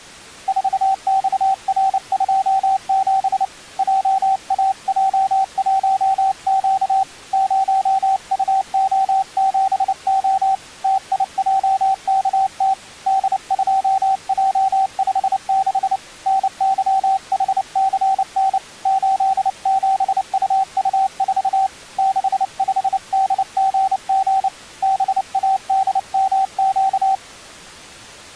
Morse code, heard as a keyed tone, hand-sent with a paddle, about 29 wpm, 770 Hz. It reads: 4XR27 JAJ1Q 0UO7O TIJKT D2J56 NYHCN 87UU4 65DGG BADMQ